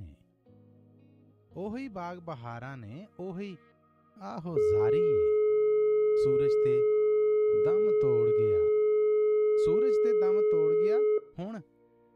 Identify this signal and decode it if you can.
Telephone call progress tone (425 Hz plan, as in most of Europe), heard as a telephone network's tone, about 420 Hz, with room echo. Dial tone.